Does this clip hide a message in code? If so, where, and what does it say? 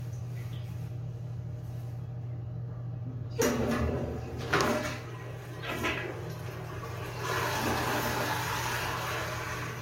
No, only the noise of a restroom.